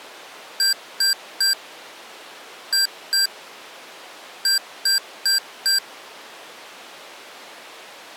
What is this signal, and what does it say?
Beep code, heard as beeps from a small speaker, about 1600 Hz. 3-2-4. In Phoenix BIOS tables: keyboard controller failure.